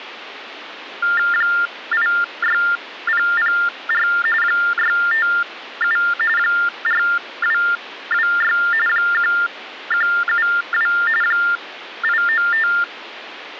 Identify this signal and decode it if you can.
TTY/TDD text telephone tones (45.45 baud Baudot), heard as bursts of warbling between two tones, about 400 Hz shift, 1600 Hz centre, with phone line noise. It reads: 86004 657 4226 1172 895